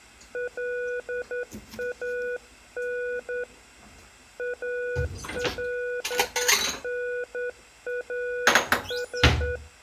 Morse code (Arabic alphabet), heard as a keyed tone, hand-sent with a straight key, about 10 wpm, 490 Hz, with room echo and kitchen noise. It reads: لان الناس